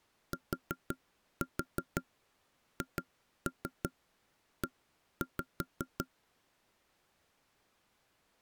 Tap code, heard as knocks on wood, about 5 knocks a second. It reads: THE